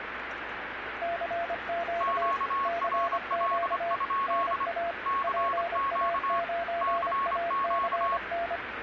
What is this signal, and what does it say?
Morse code, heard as two keyed tones, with radio static and the noise of a subway station. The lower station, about 25 wpm, 680 Hz: CQ CQ NA PA9ACN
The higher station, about 26 wpm, 1100 Hz: QRL? CQ CQ